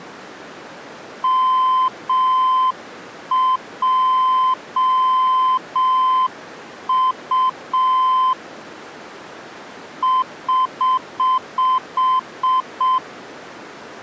Morse code, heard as a keyed tone, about 6 wpm, 1030 Hz. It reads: MJU <HH>